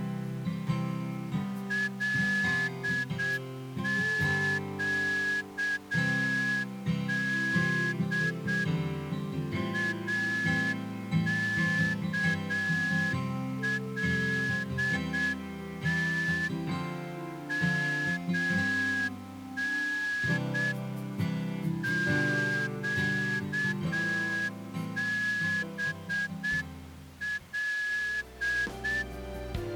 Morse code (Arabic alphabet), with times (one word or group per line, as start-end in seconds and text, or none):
1.7-8.6 لقد
9.7-16.5 اكلت
17.5-20.7 من
21.8-29.0 قبل